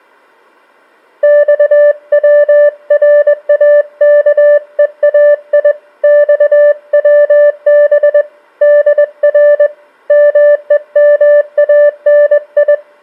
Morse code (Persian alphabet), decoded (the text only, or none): خوراکهای خوب در مهمانی